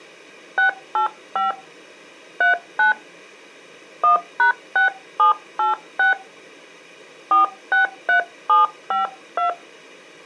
DTMF, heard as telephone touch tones, dialled by hand, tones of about 130 ms. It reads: 685 39 1#6786 463752